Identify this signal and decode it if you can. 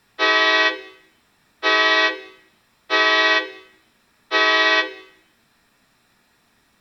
Train horn signal, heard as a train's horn, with room echo. 4 short. On North American railways: a request for a signal to be given or repeated.